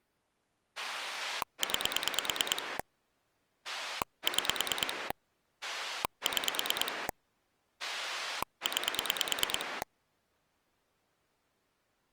Pulse dialling, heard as a rotary dial, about 9 pulses a second. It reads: 9 6 6 9